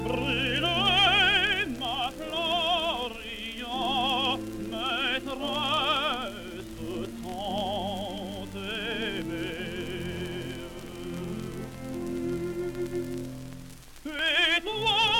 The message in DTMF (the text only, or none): none